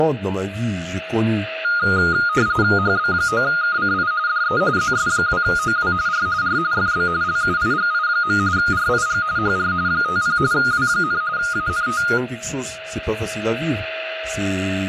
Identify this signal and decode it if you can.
RTTY (45.45 baud, 170 Hz shift), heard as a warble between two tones, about 1330 Hz centre, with a steady whistle near 640 Hz, room echo and speech in French. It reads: HB9KCI DE ZS2OW R R FB LUIGI. RIG HR 50 W, ANT